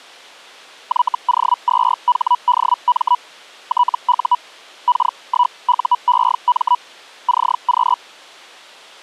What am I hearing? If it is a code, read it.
Hellschreiber (Feld-Hell, 122.5 baud), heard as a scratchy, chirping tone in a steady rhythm, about 980 Hz. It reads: YO2HDM TU K1UEM CQ